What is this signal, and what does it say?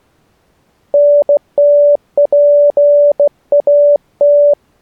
Morse code, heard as a keyed tone, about 16 wpm, 580 Hz. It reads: NTPAT